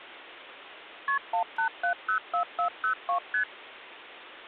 Multi-frequency trunk signalling (R1, as on North American trunks), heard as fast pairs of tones, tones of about 100 ms. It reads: KP 18704402 ST